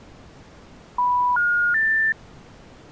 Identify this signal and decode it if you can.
Telephone call progress tone (North American plan), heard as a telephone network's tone, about 980, 1430, 1800 Hz. Special information tone.